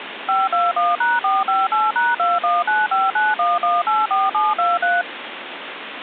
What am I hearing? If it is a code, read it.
DTMF, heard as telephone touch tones, dialled by machine, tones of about 190 ms, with phone line noise. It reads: 521#458#219591184723